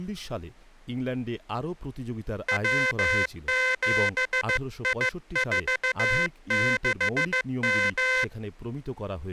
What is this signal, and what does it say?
Morse code, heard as a buzzer, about 15 wpm, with speech in Bangla. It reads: W7I46M